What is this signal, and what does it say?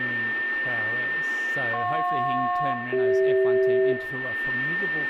Aircraft SELCAL, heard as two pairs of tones, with a steady whistle near 1810 Hz, room echo and speech in English. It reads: JP-CH